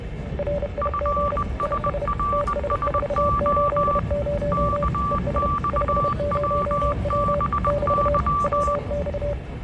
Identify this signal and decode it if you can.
Morse code, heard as two keyed tones, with the noise inside a subway train. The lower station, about 31 wpm, 580 Hz: RIG IS TS480 ES 50W <BT> WX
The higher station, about 20 wpm, 1160 Hz: FSRSO KXWBY